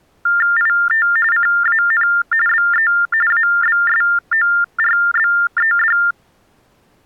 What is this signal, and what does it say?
TTY/TDD text telephone tones (45.45 baud Baudot), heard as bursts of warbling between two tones, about 400 Hz shift, 1600 Hz centre. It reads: IT CAN BE ABSORBED